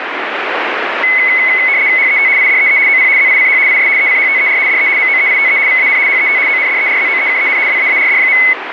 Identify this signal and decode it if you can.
RTTY (75 baud, 170 Hz shift), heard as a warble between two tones, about 2100 Hz centre, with radio static. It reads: HET IDEE OP ZICH IS ECHTER DE MOEITE VAN HET ONDERZOEKEN WAARD.